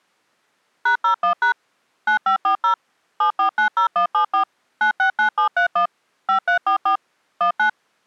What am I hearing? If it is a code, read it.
DTMF, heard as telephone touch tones, dialled by machine, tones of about 100 ms. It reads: #01# 9540 7490174 969731 5344 19